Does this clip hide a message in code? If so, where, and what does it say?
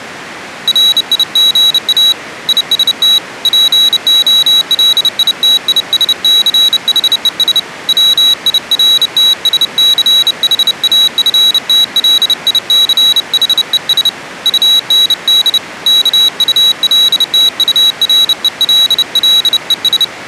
Yes: Morse code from 0.6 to 20.1 s, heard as a high beeper, hand-sent with a bug key, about 30 wpm, 3900 Hz. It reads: RIGA IST POLITISCHES WIRTSCHAFTLICHES UND KULTURELLES